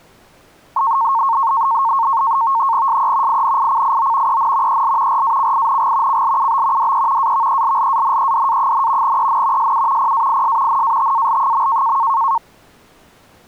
NAVTEX (SITOR-B), 100 baud, 170 Hz shift, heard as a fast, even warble, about 1000 Hz centre. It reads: SE INICIO EN EL RACING CLUB DE AVELLANEDA, EN SU PAIS NATAL.